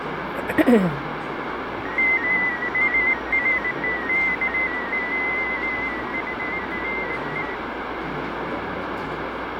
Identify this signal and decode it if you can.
Multi-tone FSK (Olivia or MFSK type), about 250 Hz wide, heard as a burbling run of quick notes, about 15.625 baud, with radio static, fading and the noise of a cafe.